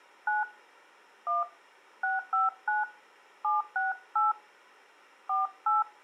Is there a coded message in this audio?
Yes: DTMF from 0.3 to 5.8 s, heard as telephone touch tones, dialled by hand, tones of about 160 ms. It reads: 9 1 659 768 48